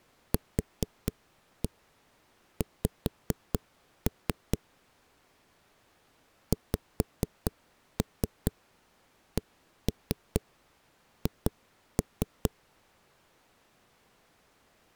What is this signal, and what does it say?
Tap code, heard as knocks on a wall, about 4 knocks a second. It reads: QX XCH